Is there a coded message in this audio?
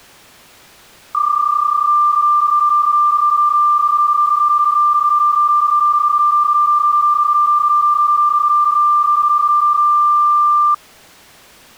Yes: PSK31 (31.25 baud) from 1.1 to 10.7 s, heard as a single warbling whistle, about 1190 Hz.